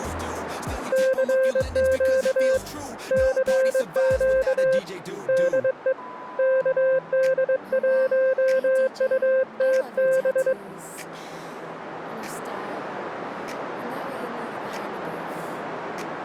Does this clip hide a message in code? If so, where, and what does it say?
Yes: Morse code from 0.9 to 10.6 s, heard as a keyed tone, hand-sent with a straight key, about 22 wpm, 520 Hz. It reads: CQ CQ DE KD1UTB